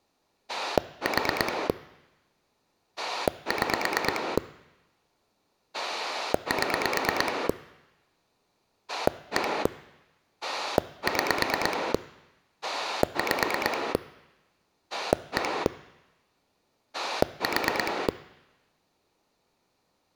Pulse dialling, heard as a rotary dial, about 9 pulses a second. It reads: 4 6 7 1 6 5 1 4